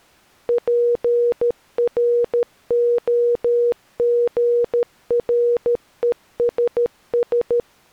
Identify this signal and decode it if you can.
Morse code (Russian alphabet), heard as a keyed tone, machine-sent, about 13 wpm, 480 Hz. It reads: ПРОГРЕСС